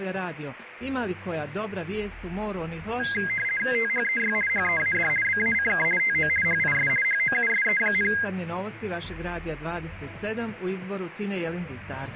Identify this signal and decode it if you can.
RTTY (50 baud, 450 Hz shift), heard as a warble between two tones, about 1850 Hz centre, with radio static. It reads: THEY HEAD BACK TO HIS HOUSE,